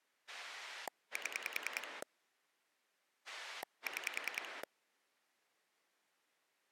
Pulse dialling, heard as a rotary dial, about 10 pulses a second. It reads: 7 6